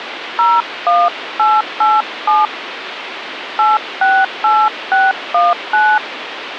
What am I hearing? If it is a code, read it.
DTMF, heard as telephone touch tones, dialled by hand, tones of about 200 ms, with phone line noise. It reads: 01887 868619